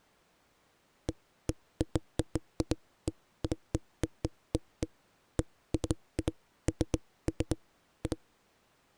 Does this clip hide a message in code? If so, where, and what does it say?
No, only irregular knocks on a wall.